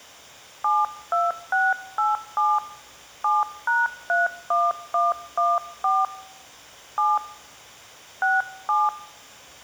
DTMF, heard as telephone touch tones, dialled by hand, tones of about 200 ms. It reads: 72687 7#31114 7 67